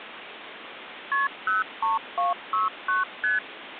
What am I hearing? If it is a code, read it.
Multi-frequency trunk signalling (R1, as on North American trunks), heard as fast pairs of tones, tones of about 160 ms, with phone line noise. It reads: KP 03269 ST